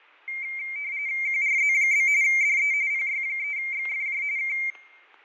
RTTY (45.45 baud, 170 Hz shift), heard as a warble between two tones, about 2200 Hz centre, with fading and static crashes. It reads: QRZ? DE PY3XFJ K